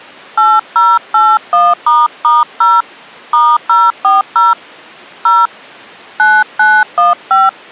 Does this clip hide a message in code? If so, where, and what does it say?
Yes: DTMF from 0.4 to 7.5 s, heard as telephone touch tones, dialled by hand, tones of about 200 ms. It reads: 8081**0 *040 0 9915